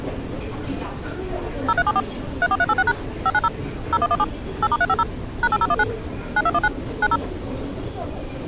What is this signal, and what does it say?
DTMF, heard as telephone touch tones, dialled by machine, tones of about 50 ms, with the noise of a crowd indoors. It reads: 0374 34386# 590 0117 8*350 #8019 9219 90